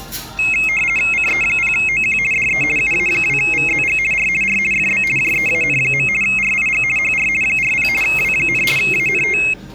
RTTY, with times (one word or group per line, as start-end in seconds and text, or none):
1.1-2.2 CE0OQ
2.3-2.6 DE
2.8-4.0 UA2VZG
4.1-4.3 R
4.4-4.6 R
4.7-5.0 FB
5.2-6.1 JEAN.
6.2-6.8 RIG
7.0-7.3 HR
7.4-7.9 40
8.0-8.6 W,
8.8-9.4 ANT